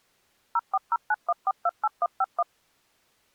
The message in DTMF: 04091428151

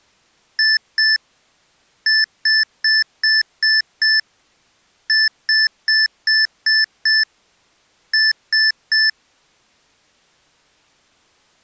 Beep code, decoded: 2-6-6-3

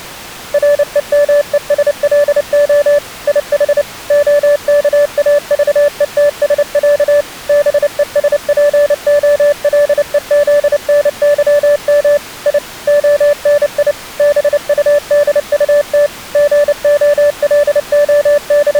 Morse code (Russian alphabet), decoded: РЕМЕСЛО ИХ ОКАЖЕТСЯ БЕСПОЛЕЗНЫМ И ОНИ БУДУТ …

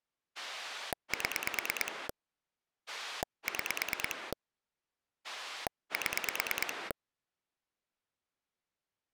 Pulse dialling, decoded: 7 6 7

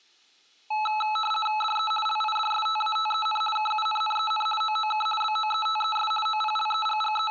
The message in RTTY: DE LIDSTATEN KUNNEN OOK BOETES …

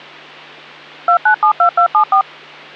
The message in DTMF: 2972274

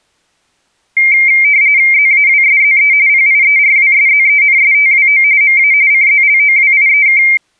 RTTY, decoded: ZAWSZE PIERWSZENSTWO MA CZLOWIEK

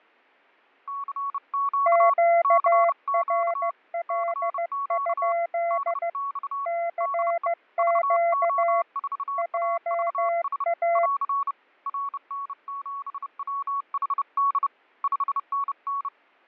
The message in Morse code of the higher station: CQ CQ CQ DX DE VO4AVS <AR> RN7WHD 5NN

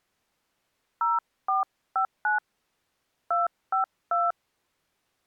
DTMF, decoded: 0459 252

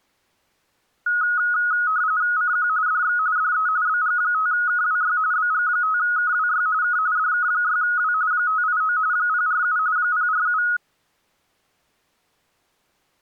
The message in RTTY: CQ DX DE BG5KWY BG5KWY K DK6W 589 047 047

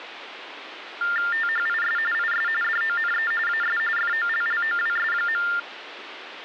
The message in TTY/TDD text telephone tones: THIS IS DONE AS FOLLOWS.

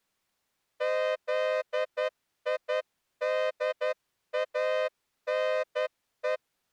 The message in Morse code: ZIDANE

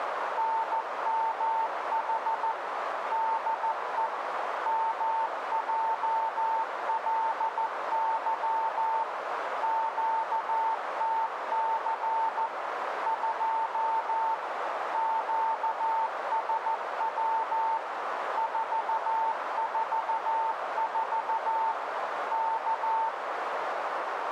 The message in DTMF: none

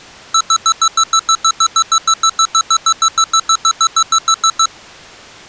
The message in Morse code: none

